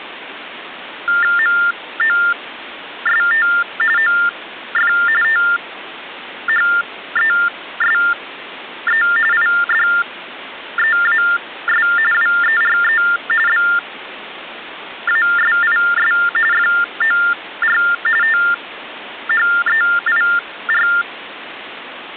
TTY/TDD text telephone tones (45.45 baud Baudot), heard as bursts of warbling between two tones, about 400 Hz shift, 1600 Hz centre, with phone line noise. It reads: MOST OF THESE IDEAS WERE BASIS FOR THEIR